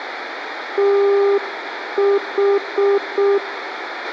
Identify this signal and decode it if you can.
Morse code, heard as a keyed tone, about 6 wpm, 400 Hz, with radio hiss, a squelch burst at the end and room echo. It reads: TH